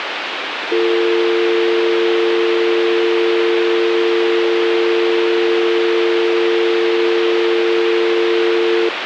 Telephone call progress tone (North American or UK plan), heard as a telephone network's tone, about 350, 450 Hz, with phone line noise. Dial tone.